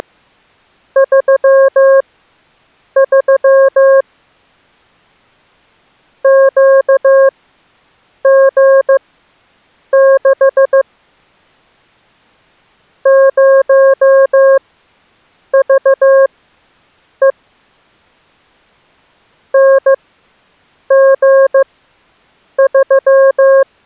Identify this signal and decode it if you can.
Morse code, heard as a keyed tone, machine-sent, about 15 wpm, spaced as for 7 wpm, 540 Hz. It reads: … QG6 0VE NG3